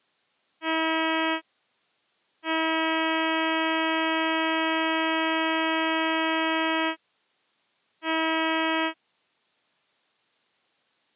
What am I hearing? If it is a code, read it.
Ship horn signal, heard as a ship's horn, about 320 Hz. 1 short, 1 long, 1 short. At sea: a vessel at anchor warns of its position.